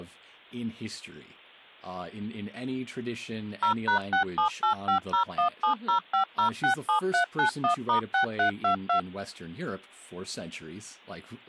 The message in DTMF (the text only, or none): 0#678501705067391*6322